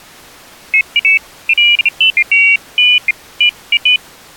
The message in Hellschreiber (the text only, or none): none